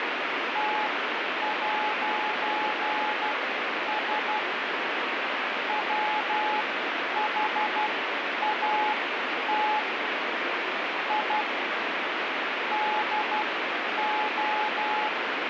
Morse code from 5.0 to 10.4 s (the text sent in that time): WHAT